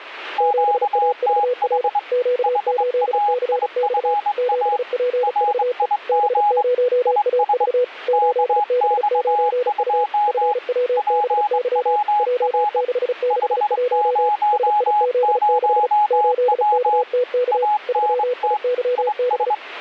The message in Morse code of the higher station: QTH HAIFA RIG IS KX2 PWR 500W ANT IS

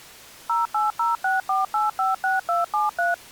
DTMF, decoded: 08064856273

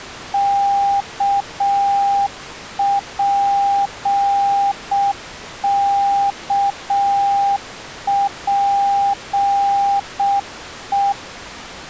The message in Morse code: KPKPE

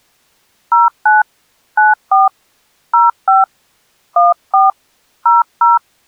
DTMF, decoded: 09 94 05 14 00

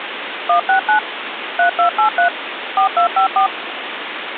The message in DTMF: 169 3283 4254

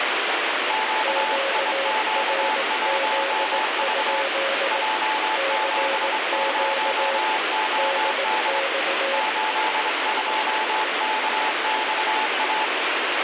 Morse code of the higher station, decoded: QIQ1V J70OD 82KXA

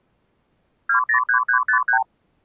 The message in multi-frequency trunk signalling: 203353

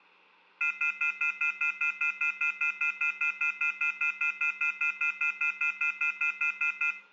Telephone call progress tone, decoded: off-hook warning tone

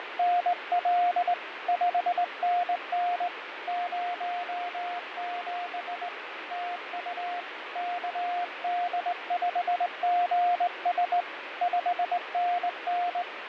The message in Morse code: … 5NN 07 TU KD5GS 5NN

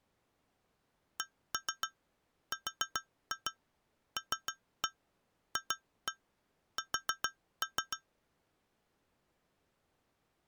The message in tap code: CRLFS

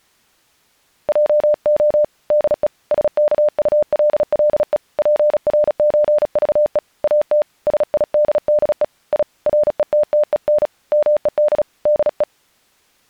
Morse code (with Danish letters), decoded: JO DE SKULLE PRØVE AT SIDDE I RETTEN MED DE

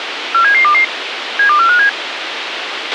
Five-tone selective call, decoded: 47722 72457

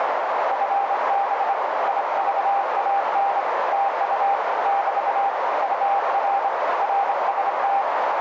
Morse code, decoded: FB IVAN TU <BT> UR RST

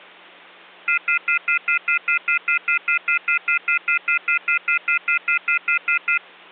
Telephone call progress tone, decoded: off-hook warning tone

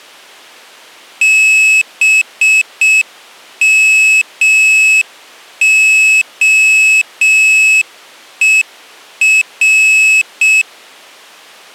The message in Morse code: BMOER

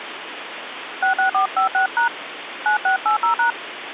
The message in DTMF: 66456# 9680#

